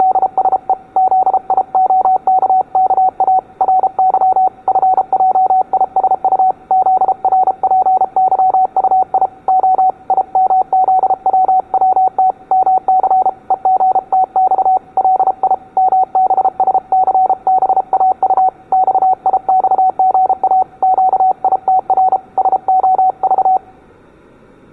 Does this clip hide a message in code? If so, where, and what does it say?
Yes: Morse code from 0.0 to 23.6 s, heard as a keyed tone, hand-sent with a paddle, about 33 wpm, 750 Hz, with room echo. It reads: … ZIOKKA RY FJISU ZRPYUI O IMZWWT MC EGTX LI MBSCBAU XIXGA QITR SOV